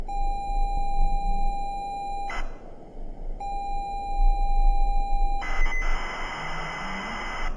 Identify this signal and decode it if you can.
ZX Spectrum tape loading, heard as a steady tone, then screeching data, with room echo.